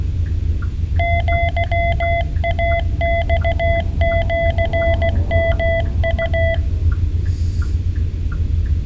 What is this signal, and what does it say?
Morse code (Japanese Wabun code), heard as a keyed tone, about 16 wpm, 670 Hz, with room echo and the noise inside a car. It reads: アイマシヨウ